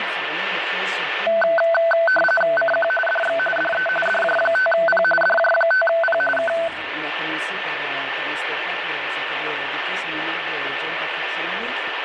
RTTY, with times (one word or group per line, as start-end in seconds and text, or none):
2.6-2.9 CQ
3.1-3.4 DX
3.6-3.9 DE
4.1-5.0 DJ5P
5.2-6.2 DJ5P
6.4-6.5 K